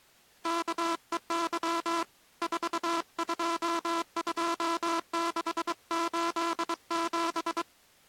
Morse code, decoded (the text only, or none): KEY 422687